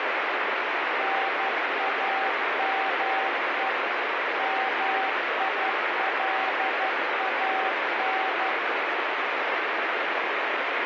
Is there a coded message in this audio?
Yes: Morse code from 0.9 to 8.6 s, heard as a keyed tone, machine-sent, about 12 wpm, 770 Hz, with heavy radio static. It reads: NAME MILAN